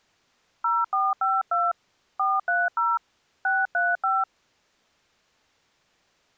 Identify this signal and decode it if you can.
DTMF, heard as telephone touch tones, dialled by hand, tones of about 200 ms. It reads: 0452 430 635